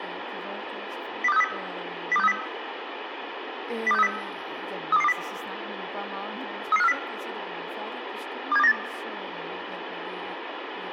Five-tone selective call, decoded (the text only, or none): 02630 02630 02630 32220 33540 27298